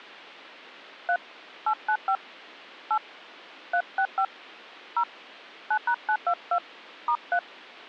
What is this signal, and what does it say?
DTMF, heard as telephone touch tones, dialled by hand, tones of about 70 ms. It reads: 3 895 8 365 0 9#922 *3